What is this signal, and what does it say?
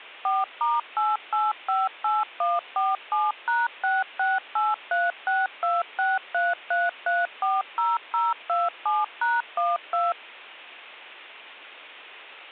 DTMF, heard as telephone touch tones, dialled by machine, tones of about 190 ms. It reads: 4*8858147#668362633340027#12